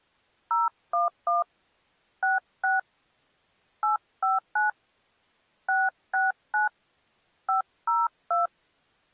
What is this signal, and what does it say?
DTMF, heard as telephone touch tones, dialled by hand, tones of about 160 ms. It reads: 011 66 859 669 502